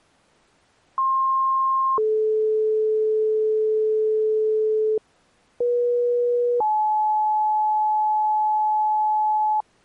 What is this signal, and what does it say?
Two-tone page, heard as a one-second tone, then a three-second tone, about 1060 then 430 Hz, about 480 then 860 Hz.